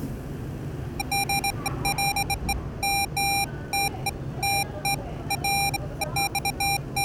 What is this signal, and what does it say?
Beeps of irregular length, with the noise inside a subway train. There is no code.